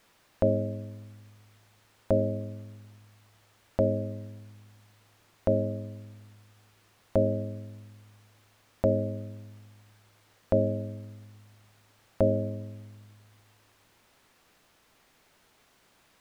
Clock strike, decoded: 8

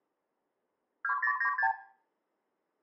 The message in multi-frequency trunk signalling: 2096

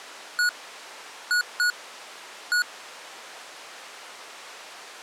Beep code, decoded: 1-2-1

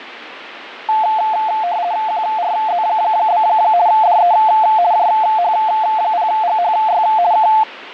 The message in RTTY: QRZ? DE JH0GHY K

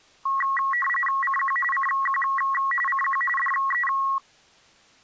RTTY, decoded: CQ CQ CQ DE

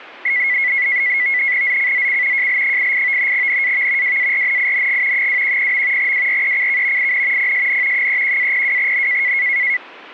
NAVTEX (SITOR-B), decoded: ZCZC JL88 NAV WARNING 210. WRECK IN PSN 31-02N

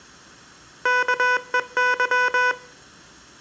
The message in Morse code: KEY

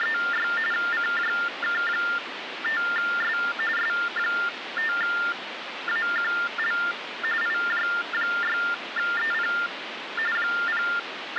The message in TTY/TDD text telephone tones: … CJK5S S5AQL IJ6EP …

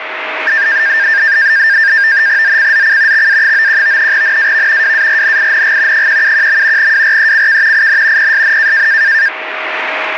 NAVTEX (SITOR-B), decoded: ZCZC XA91 NAV WARNING 171. WRECK IN PSN

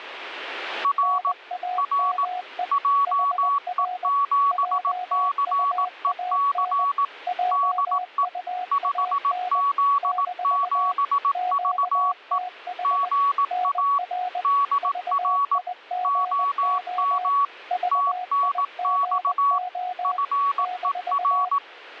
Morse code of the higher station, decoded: R R JE7CEC DE 5Z7VE GA DR OM TNX FER

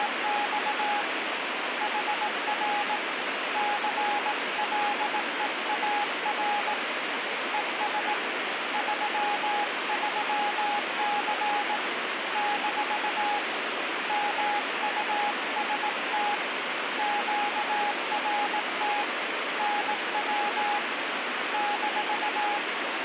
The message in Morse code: … HR CLEAR ES 33C - MUST QRT NW -

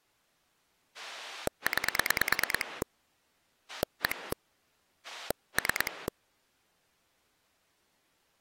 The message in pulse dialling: 9 1 3

